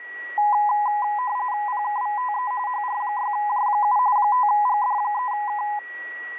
RTTY (45.45 baud, 170 Hz shift), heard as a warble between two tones, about 920 Hz centre, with a steady whistle near 1930 Hz. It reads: PKVTE HR6J7 5GD3K